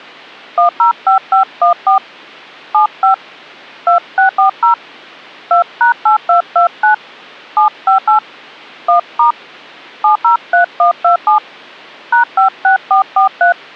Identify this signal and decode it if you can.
DTMF, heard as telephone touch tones, dialled by hand, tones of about 120 ms. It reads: 105514 75 2640 2#8229 758 1* 703127 #56443